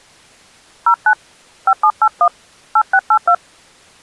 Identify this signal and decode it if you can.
DTMF, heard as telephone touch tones, dialled by hand, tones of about 70 ms. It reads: 09 5781 8682